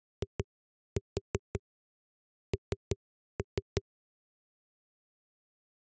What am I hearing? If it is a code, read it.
Tap code, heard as knocks on a wall, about 5 knocks a second. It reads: IN